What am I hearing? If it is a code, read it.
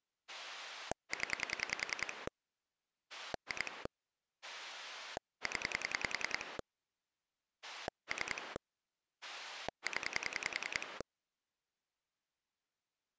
Pulse dialling, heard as a rotary dial, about 10 pulses a second. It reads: 0 2 0 3 0